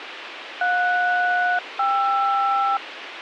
Aircraft SELCAL, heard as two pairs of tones, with radio hiss. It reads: JS-KR